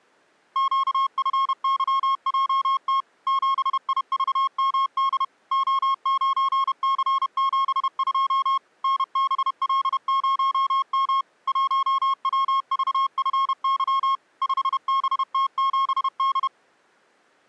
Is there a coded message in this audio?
Yes: Morse code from 0.5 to 16.5 s, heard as a keyed tone, machine-sent, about 31 wpm, 1080 Hz. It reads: QFYJT 7IVMD O9C72 NBL0M 1WVFY 5BT7D